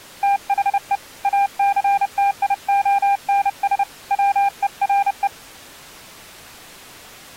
Morse code, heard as a keyed tone, hand-sent with a paddle, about 30 wpm, 800 Hz. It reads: THE ACTIONS WERE